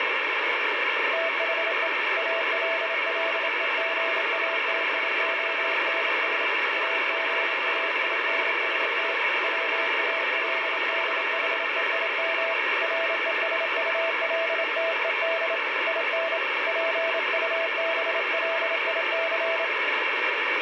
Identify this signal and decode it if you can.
Morse code, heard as a keyed tone, hand-sent with a paddle, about 27 wpm, 660 Hz, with heavy radio static. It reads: THE ALLEGATIONS AGAINST WALDHEIM RESULTED IN PUBLIC